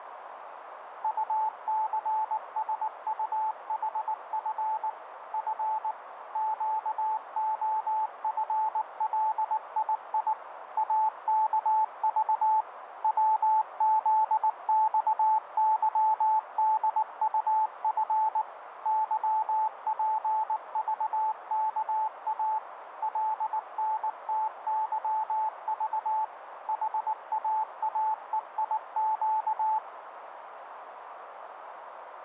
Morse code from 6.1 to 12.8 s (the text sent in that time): QOFLII AKV